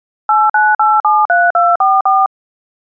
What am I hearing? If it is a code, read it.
DTMF, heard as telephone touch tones, dialled by machine, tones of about 210 ms. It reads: 89873244